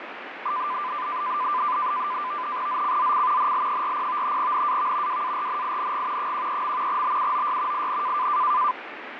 NAVTEX (SITOR-B), 100 baud, 170 Hz shift, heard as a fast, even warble, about 1100 Hz centre, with radio static and fading. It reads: ZCZC NL40 NAV WARNING 13. BUOY IN